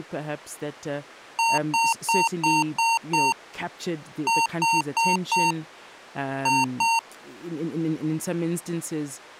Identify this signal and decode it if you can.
Beep code, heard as beeps from a small speaker, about 920 Hz, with speech in English. 6-4-2.